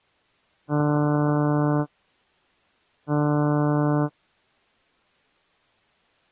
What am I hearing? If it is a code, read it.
Ship horn signal, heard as a ship's horn, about 150 Hz. 2 short. At sea: I am altering course to port.